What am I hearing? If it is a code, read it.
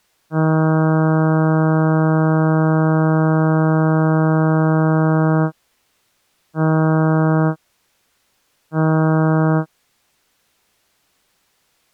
Ship horn signal, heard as a ship's horn, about 160 Hz. 1 long, 2 short. At sea: a vessel in fog that is sailing, fishing, towing or hampered.